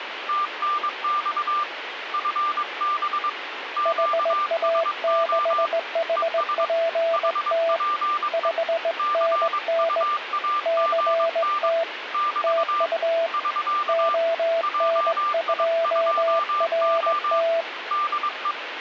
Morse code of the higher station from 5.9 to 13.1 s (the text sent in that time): ES HPE CUAGN <BT>